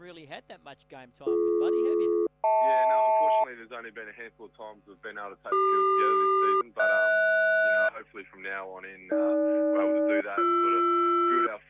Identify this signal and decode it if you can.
Aircraft SELCAL, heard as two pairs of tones. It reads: BD-HL CQ-HS AG-BR